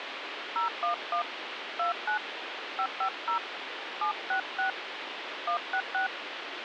DTMF, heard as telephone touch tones, dialled by hand, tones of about 100 ms, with phone line noise. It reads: 011 29 550 766 166